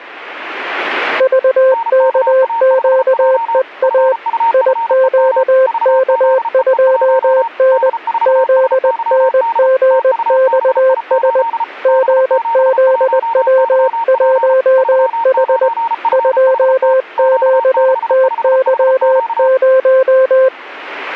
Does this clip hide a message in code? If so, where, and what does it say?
Yes: Morse code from 1.1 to 20.5 s, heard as two keyed tones. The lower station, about 20 wpm, 520 Hz: VKQEA IQK2N ZNGXS GZW1H 2QTY0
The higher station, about 34 wpm, 920 Hz: NKA5J FUFEM VZEE1 D4SYD TUBI8 B71YP 39FHT Q65HQ